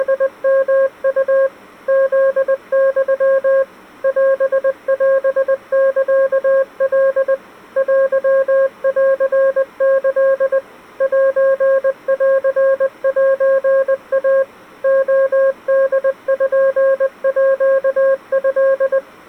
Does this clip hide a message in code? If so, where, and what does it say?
Yes: Morse code (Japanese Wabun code) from 0.0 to 19.0 s, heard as a keyed tone, machine-sent, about 20 wpm, 540 Hz. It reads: … フユ オオサカ テンキ センセイ レポート